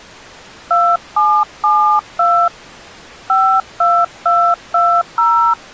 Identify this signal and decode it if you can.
DTMF, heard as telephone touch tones, dialled by hand, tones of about 280 ms. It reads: 2772 52220